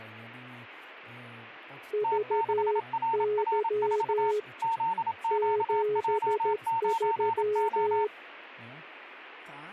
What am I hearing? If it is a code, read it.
Morse code, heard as two keyed tones, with speech in Polish. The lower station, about 13 wpm, 420 Hz: VY 73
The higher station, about 27 wpm, 910 Hz: T6RR4 ZQJ9O